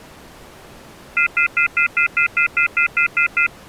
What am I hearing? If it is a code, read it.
Telephone call progress tone (North American plan), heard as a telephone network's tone, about 1400, 2050, 2450, 2600 Hz, 0.1 s on and 0.1 s off. Off-hook warning tone.